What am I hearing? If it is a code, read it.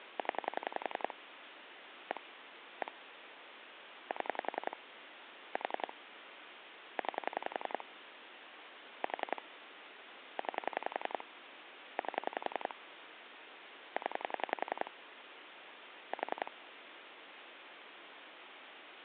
Pulse dialling, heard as clicks on a phone line, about 11 pulses a second, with phone line noise. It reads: 0 1 1 7 4 9 4 9 8 0 4